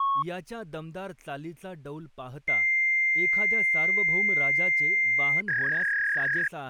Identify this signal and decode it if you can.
Fax machine handshake, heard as a long tone and a warble, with speech in Marathi.